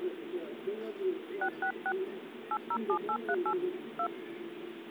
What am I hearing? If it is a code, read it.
DTMF, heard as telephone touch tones, dialled by hand, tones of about 70 ms, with the noise of a park. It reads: 666 807838 2